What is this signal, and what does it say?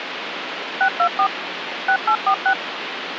DTMF, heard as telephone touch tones, dialled by machine, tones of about 80 ms, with phone line noise. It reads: 624 6846